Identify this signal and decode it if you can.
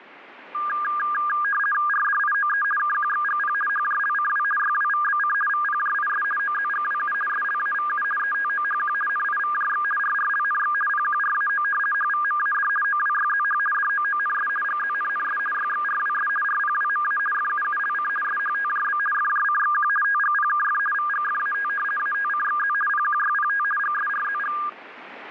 RTTY (50 baud, 450 Hz shift), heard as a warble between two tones, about 1420 Hz centre, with radio static. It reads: RDIOE KQXGP HJLCW YWVBC VPJIS OZGWU SLAVU ETOHQ NIVJX RRLNX PQRAO HVMAD OWYZH DOONS GZNNS YXRWS RPWMA FUULC SHTJB FJCXQ TGPKF VGFAT ATCXZ PQYPT GSRZG